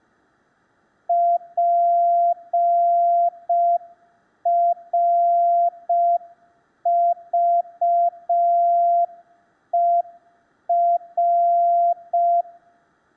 Morse code, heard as a keyed tone, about 5 wpm, 690 Hz, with room echo. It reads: PRVER